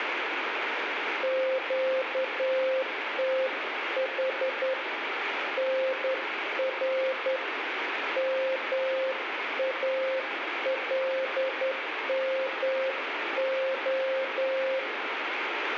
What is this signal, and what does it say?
Morse code, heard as a keyed tone, hand-sent with a straight key, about 10 wpm, 530 Hz, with radio static and room echo. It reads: QTH NR MALMO